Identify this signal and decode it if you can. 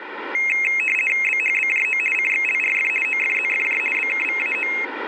RTTY (50 baud, 450 Hz shift), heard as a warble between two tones, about 2350 Hz centre, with radio static. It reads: BHBJO CXLRF OFZFJ BKVAO